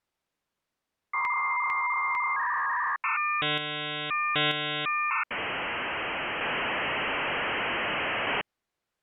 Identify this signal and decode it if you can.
Dial-up modem handshake (V.34 or later), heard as a whistle, warbles, then hiss.